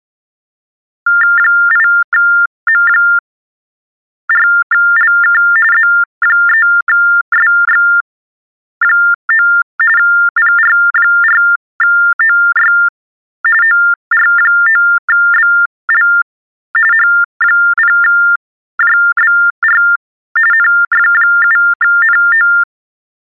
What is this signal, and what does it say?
TTY/TDD text telephone tones (45.45 baud Baudot), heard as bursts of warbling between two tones, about 400 Hz shift, 1600 Hz centre. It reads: 8M4LK Z3SX9 PR4OY OR9BL H0JBR NF7NO